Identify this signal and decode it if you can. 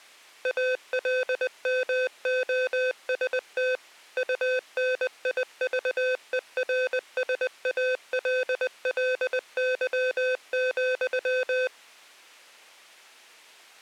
Morse code, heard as electronic beeps, machine-sent, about 20 wpm, 510 Hz. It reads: ALMOST UNIVERSALLY,